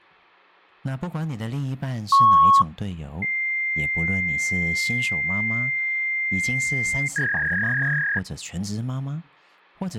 Fax machine handshake, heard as a beep, a long tone and a warble, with hum and speech in Chinese.